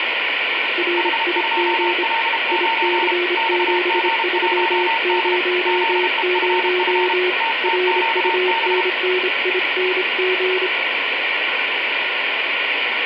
Morse code, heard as two keyed tones, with radio static and room echo. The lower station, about 26 wpm, 360 Hz: RIG IC7300 RUNNING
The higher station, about 32 wpm, 910 Hz: H2L9 XG1D ZEFF TTQB